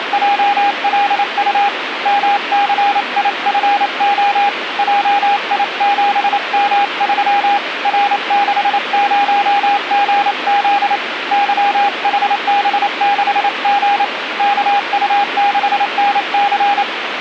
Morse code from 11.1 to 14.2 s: YHB6G

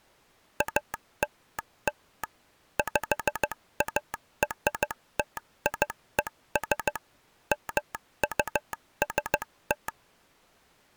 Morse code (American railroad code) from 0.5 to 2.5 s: ALL

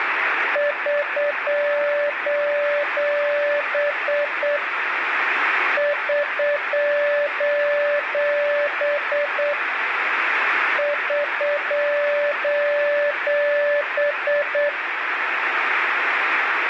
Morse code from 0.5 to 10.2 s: <SOS> <SOS>

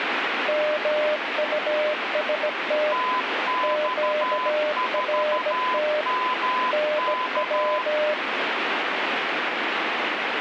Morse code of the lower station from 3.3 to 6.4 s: QRT

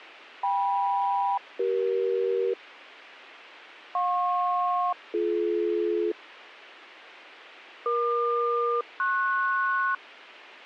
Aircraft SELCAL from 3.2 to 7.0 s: JP-BD

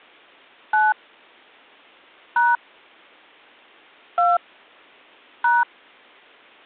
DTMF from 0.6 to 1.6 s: 9

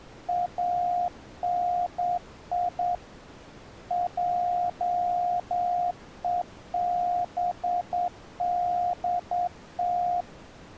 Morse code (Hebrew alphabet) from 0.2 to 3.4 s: אני

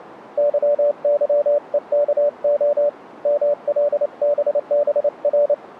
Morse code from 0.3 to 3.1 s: YYEKO

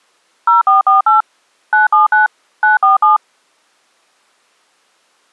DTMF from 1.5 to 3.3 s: 979 947

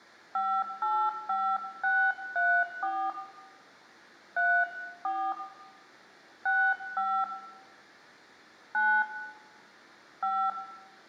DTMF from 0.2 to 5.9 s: 585634 34

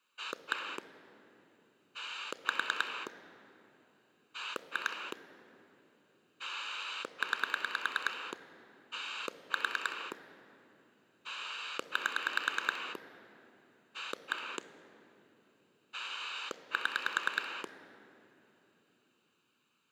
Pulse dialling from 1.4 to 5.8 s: 4 2

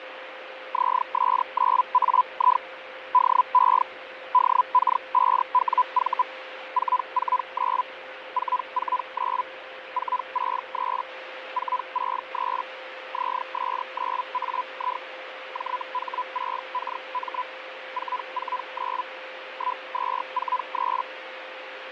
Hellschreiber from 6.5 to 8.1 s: 449

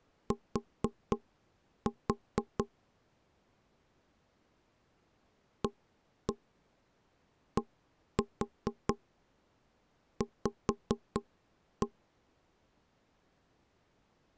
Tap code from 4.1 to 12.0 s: ADV

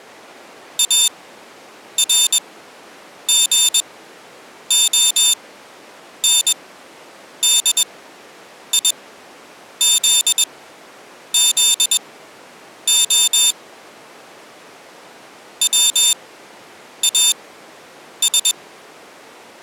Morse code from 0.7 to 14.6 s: ARGONDIZZO

